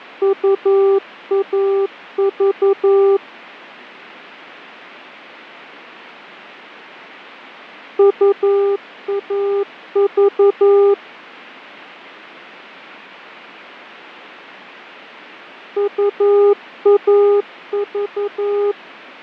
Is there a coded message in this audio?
Yes: Morse code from 0.2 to 18.8 s, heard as a keyed tone, machine-sent, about 11 wpm, 400 Hz, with fading. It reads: UAV UAV UAV